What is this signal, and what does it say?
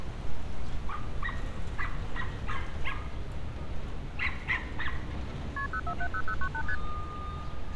Multi-frequency trunk signalling (R1, as on North American trunks), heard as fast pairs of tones, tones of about 70 ms, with street noise. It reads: KP 0470098 ST